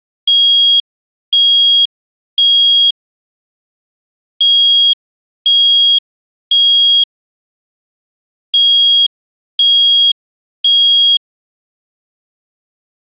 Alarm pattern, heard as an alarm's beeps, played three times, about 3300 Hz. Temporal three. Smoke or fire, evacuate.